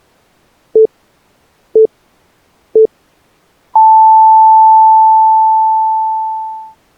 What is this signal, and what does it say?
Radio time signal (three low pips and a long one an octave up, as on NHK), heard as pips.